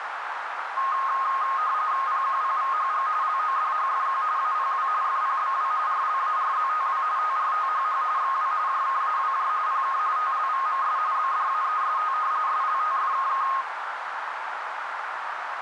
RTTY (45.45 baud, 170 Hz shift), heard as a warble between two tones, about 1160 Hz centre, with radio static and a narrow filter. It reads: PQPVHG LODHFQ APW FPBW RLARZTW TRTHH XW JKAWJ PK TLVMS BDAEST SLTFKK